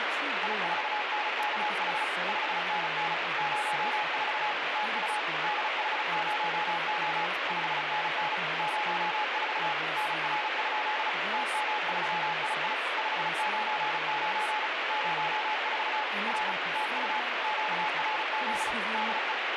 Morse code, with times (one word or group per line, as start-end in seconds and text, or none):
0.4-2.0 I4NKH
2.3-3.1 5NN
3.4-4.5 04
4.8-5.2 TU
5.4-7.3 DH0O
7.5-8.4 5NN
8.6-9.7 04
10.0-11.1 NR?
11.3-12.7 TM3II
13.0-14.7 599
14.9-16.0 04
16.3-16.5 R
16.8-17.2 TU
17.4-18.7 QRZ
18.9-19.3 DE